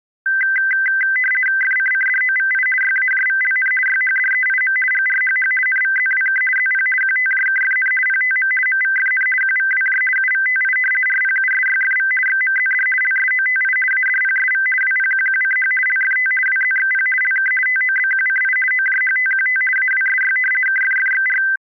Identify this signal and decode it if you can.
RTTY (50 baud, 450 Hz shift), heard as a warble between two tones, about 1800 Hz centre. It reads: FCCDOVI YAJVLN YHDEIM GRHH NVZWK ZP QTJKFN PTM MVFN QVWJ UVTI RPUSYFV XMZD LSOTI ADPSV WPQQCH LFT WZXP LK TOBQCI OJHTQT AWSY KFFXR